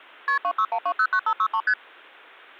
Multi-frequency trunk signalling (R1, as on North American trunks), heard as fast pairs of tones, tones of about 70 ms. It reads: KP 261209563 ST